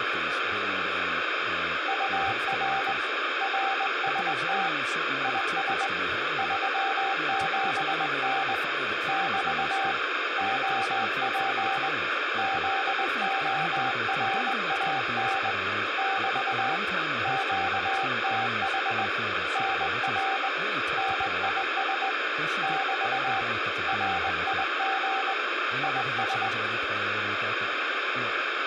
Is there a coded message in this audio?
Yes: Morse code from 1.8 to 26.5 s, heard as a keyed tone, hand-sent with a straight key, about 20 wpm, 780 Hz, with radio static, room echo and speech in English. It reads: UR RST IS 37N <BT> OP ZORAN <BT> QTH NR NIS <BT> RIG IS